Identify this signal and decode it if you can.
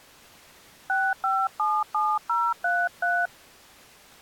DTMF, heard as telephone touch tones, dialled by hand, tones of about 230 ms. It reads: 6577033